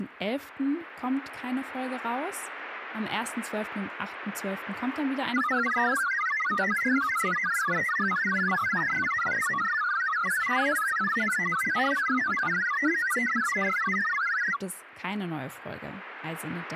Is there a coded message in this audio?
Yes: multi-tone FSK (Olivia or MFSK type), about 1000 Hz wide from 5.3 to 14.6 s, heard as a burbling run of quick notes, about 62.5 baud.